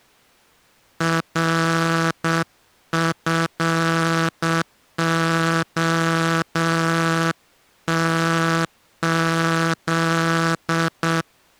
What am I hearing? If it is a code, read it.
Morse code, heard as a buzzer, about 7 wpm. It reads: RFOTZ